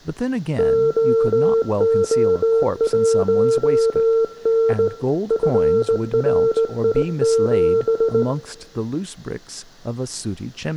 Morse code, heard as a keyed tone, hand-sent with a straight key, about 19 wpm, 450 Hz, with room echo and speech in English. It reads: OO1N FRI7